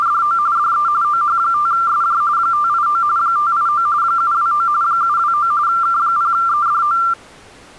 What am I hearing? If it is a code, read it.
RTTY (45.45 baud, 170 Hz shift), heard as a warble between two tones, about 1270 Hz centre. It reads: … DE OH5SJ 589 589 729 729 K0EDO